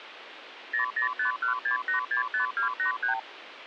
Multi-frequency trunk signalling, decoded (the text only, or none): 00516865283